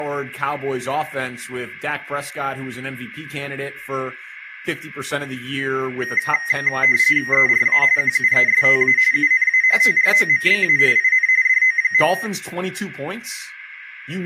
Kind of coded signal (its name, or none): RTTY